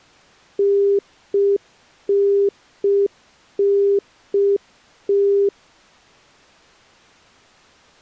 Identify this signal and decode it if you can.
Telephone call progress tone (UK plan), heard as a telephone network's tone, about 400 Hz. Congestion tone.